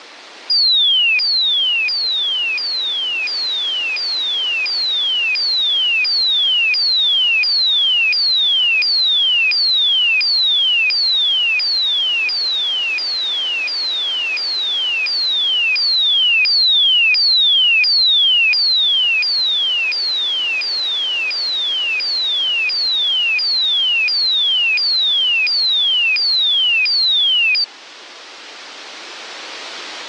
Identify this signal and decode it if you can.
A tone that sweeps in pitch again and again, with radio static. There is no code.